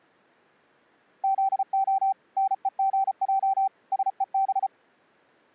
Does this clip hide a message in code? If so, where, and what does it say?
Yes: Morse code (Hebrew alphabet) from 1.2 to 4.7 s, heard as a keyed tone, machine-sent, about 34 wpm, 780 Hz. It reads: זה נוגע שוב